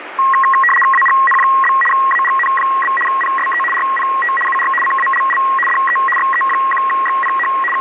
RTTY (75 baud, 850 Hz shift), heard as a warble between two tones, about 1500 Hz centre, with radio static. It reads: AGN? AGN? PSE RPT UR CALL DE XE1XPH …